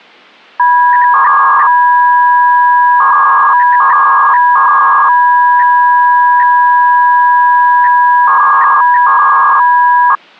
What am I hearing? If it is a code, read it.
300-baud modem data (V.21 tones), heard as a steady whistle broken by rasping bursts, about 300 baud, 200 Hz shift.